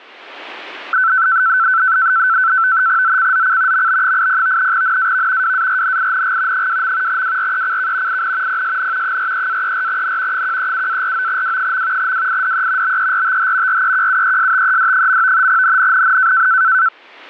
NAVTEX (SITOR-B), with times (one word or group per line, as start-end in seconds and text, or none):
3.0-3.9 ZCZC
3.7-4.7 MB80
4.7-5.5 NAV
5.4-6.7 WARNING
6.5-7.2 2.
7.1-8.2 WRECK
8.1-8.6 IN
8.5-9.2 PSN
9.0-10.4 43-34N
10.3-12.1 137-49W.
12.0-13.0 WIDE
12.8-13.8 BERTH
13.7-15.5 REQUESTED.
15.5-16.5 NNNN